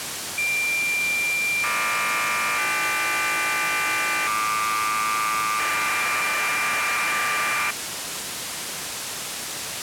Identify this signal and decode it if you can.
Cassette data (Kansas City type), 1200 baud, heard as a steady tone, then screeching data, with tape hiss.